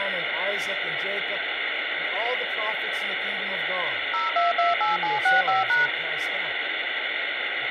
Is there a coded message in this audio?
Yes: DTMF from 4.1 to 5.9 s, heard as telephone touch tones, dialled by machine, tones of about 160 ms, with phone line noise. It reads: 0228765#